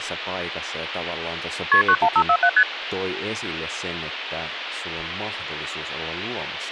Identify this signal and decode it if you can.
Multi-frequency trunk signalling (R1, as on North American trunks), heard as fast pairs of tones, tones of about 70 ms, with phone line noise and speech in Finnish. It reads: KP 91547 ST